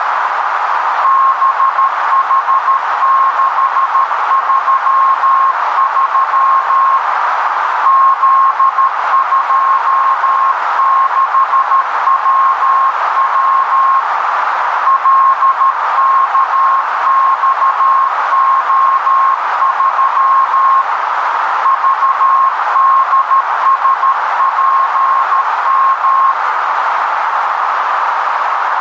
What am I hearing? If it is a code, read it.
Morse code, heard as a keyed tone, hand-sent with a paddle, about 13 wpm, 1070 Hz, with heavy radio static and a narrow filter. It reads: BH633 Z26WW LKXO3 VDSPM